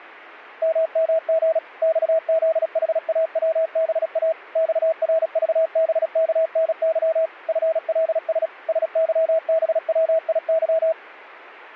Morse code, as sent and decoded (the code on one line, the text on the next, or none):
-- -- --. / -..- --.. .... .- .-- -... .- / -..- .-. ...- -... -.- -. -.-- / ..-. .-.. ... / ... -.-- -... .-- .. -.--
MMG XZHAWBA XRVBKNY FLS SYBWIY